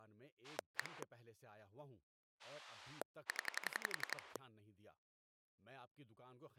Pulse dialling, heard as a rotary dial, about 11 pulses a second, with speech in Urdu. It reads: 1 0